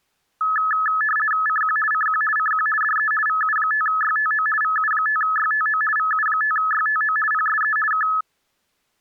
RTTY (50 baud, 450 Hz shift), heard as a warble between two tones, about 1500 Hz centre. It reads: CQ CQ CQ DE VU5YTO VU5YTO VU5YTO PSE K